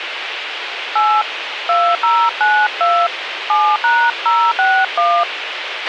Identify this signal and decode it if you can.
DTMF, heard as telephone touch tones, dialled by hand, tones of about 260 ms, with radio hiss and a squelch burst at the end. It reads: 8 2092 7#061